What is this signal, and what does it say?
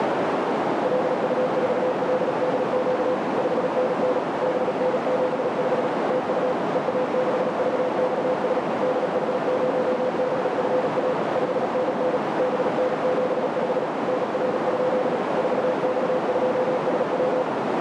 Morse code, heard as a keyed tone, machine-sent, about 37 wpm, 510 Hz, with heavy radio static and a narrow filter. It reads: LU4LDQ 5NN BN75 TU EA6VXS DH0BFA 5NN BN75 NR? 4X2SW